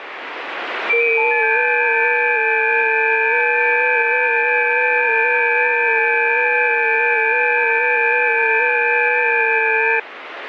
FT8 (several signals at once), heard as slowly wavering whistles, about 6.25 baud, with radio static.